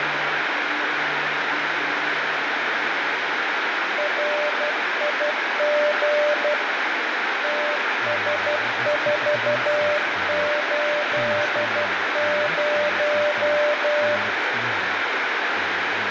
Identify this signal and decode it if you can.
Morse code, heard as a keyed tone, hand-sent with a paddle, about 12 wpm, 590 Hz, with heavy radio static. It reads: RIG TS480